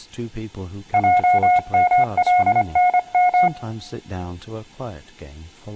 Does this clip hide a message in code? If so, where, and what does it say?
Yes: Morse code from 0.9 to 3.5 s, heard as a keyed tone, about 25 wpm, 720 Hz, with room echo and speech in English. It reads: JMLNM